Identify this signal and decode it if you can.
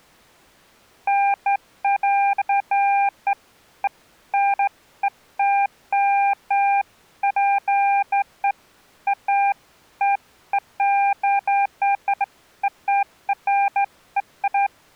Beeps of irregular length. There is no code.